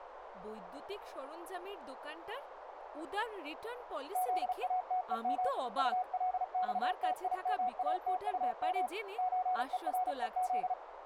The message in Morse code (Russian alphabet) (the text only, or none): ЗАТЕМ УЛЬТИМАТУМ ЧЕРЕЗ